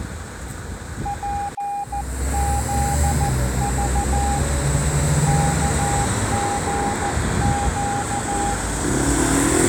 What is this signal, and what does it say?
Morse code, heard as a keyed tone, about 14 wpm, 810 Hz, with street noise. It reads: PZV KGQ